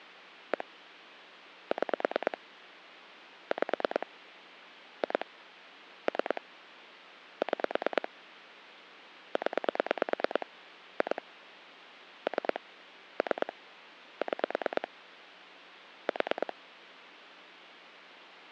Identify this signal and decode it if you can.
Pulse dialling, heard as clicks on a phone line, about 9 pulses a second. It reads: 1 6 5 2 3 6 0 2 3 3 6 4